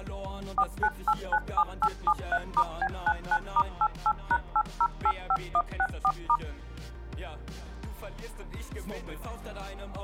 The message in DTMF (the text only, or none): 49897873*B99*88#8085164*